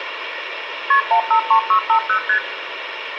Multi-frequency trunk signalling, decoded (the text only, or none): KP 153650 ST